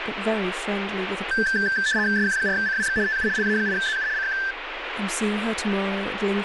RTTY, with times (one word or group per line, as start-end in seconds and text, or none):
2.2-3.0 SQ4CWX
3.1-3.3 TU
3.4-4.1 LA8ZU
4.2-4.4 CQ